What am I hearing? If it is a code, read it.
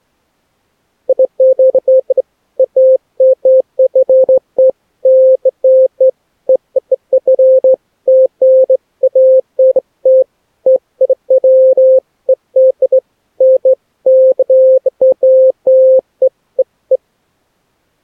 Beeps of irregular length. There is no code.